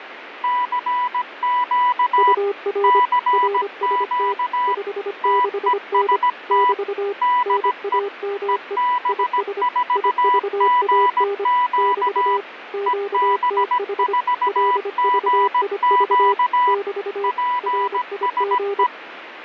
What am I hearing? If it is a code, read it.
Morse code, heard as two keyed tones, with radio static. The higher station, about 17 wpm, 990 Hz: CQ CQ TEST DE EB4GQ EB4GQ PSE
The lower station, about 25 wpm, 400 Hz: UR RST 56N <BT> NAME IS IVAN <BT> QTH LVIV <BT> RIG